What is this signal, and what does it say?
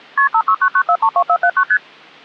Multi-frequency trunk signalling (R1, as on North American trunks), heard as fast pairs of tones, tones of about 70 ms. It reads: KP 5699432479 ST